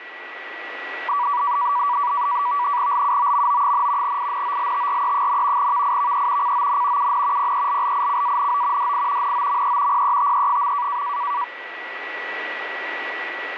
NAVTEX (SITOR-B), 100 baud, 170 Hz shift, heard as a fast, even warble, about 1060 Hz centre, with radio static and a steady whistle near 1940 Hz. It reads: LUOMO, INOLTRE, VIVE CON UN PELLICANO DI NOME PETE.